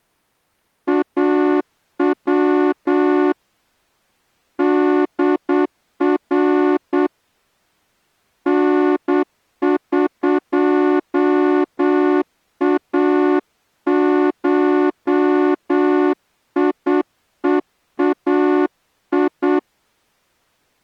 Morse code (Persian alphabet), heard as a horn, hand-sent with a straight key, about 8 wpm. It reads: او در نقاشیهای